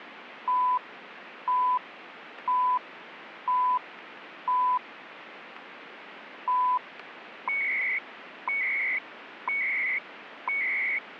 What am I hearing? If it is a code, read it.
Radio time signal (CHU, Canada), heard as beeps and data bursts, one a second, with radio static.